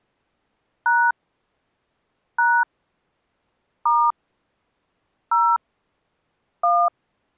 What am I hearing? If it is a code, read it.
DTMF, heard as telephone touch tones, dialled by hand, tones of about 250 ms. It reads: # # * 0 1